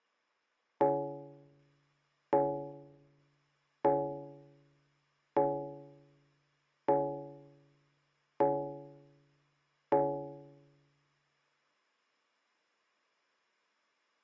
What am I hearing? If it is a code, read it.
Clock strike, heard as a bell. 7. Seven o'clock.